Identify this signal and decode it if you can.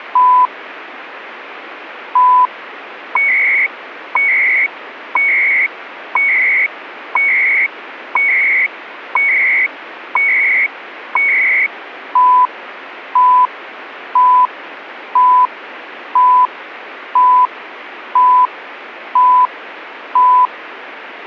Radio time signal (CHU, Canada), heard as beeps and data bursts, one a second, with radio static.